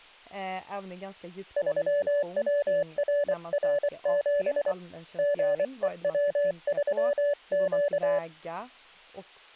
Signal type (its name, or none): Morse code